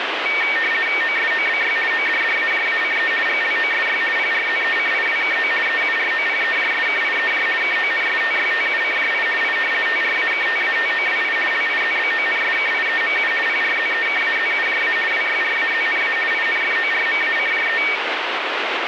RTTY (50 baud, 450 Hz shift), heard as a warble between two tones, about 2050 Hz centre, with radio static. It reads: OSOBY ODDAJACE GLOSY PRZECIWKO EUROPEJSKIEJ KONSTYTUCJI I TRAKTATOWI LIZBONSKIEMU PRZEKAZUJA WYRAZNA INFORMACJE